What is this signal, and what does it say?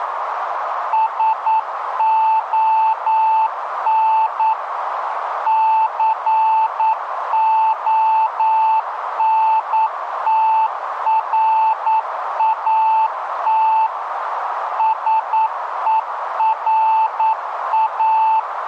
Morse code, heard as a keyed tone, machine-sent, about 9 wpm, 880 Hz, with radio static and a narrow filter. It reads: SON CONTRAT SERA